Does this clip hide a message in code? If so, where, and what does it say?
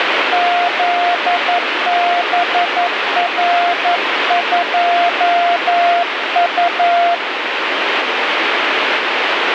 Yes: Morse code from 0.3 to 7.2 s, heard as a keyed tone, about 11 wpm, 700 Hz, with heavy radio static. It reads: ZBR2U